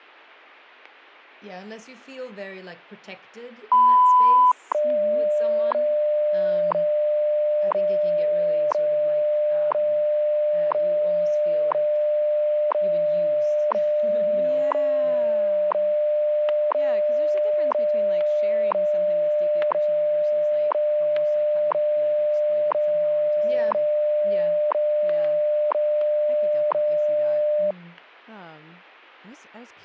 Radio time signal (WWV, Colorado), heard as ticks, one a second, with static crashes and speech in English.